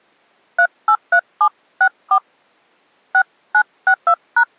DTMF, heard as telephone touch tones, dialled by hand, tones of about 70 ms. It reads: 383764 6962#